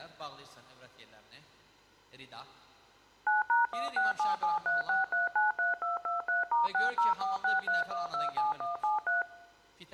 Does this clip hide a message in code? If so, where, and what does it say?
Yes: DTMF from 3.3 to 9.2 s, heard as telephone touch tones, dialled by machine, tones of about 150 ms. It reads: 9#167736393223*60463127173